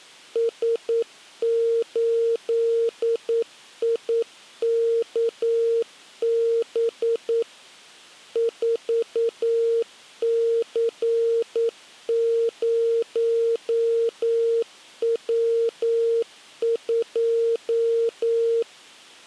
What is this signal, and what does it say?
Morse code, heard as a keyed tone, machine-sent, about 9 wpm, 460 Hz. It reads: S8IKB 4C0W2